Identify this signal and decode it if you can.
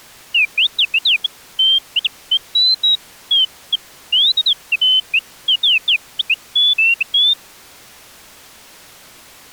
Bird-like chirps. There is no code.